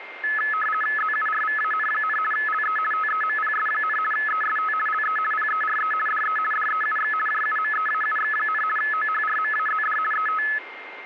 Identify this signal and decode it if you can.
RTTY (50 baud, 450 Hz shift), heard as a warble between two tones, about 1500 Hz centre, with radio static and a steady whistle near 2110 Hz. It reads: ZURVAN, LE TEMPS, EST LE PERE DE DEUX JUMEAUX, OHRMAZD ET